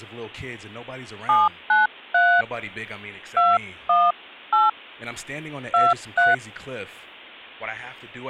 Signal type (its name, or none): DTMF